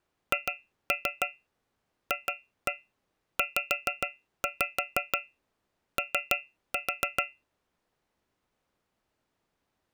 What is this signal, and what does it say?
Tap code, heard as taps on a metal pipe, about 6 knocks a second. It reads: HFZO